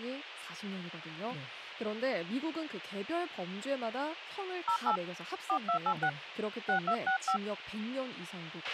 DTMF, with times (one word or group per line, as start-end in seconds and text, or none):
4.7-5.0 08
5.5-6.1 4286
6.7-7.4 6265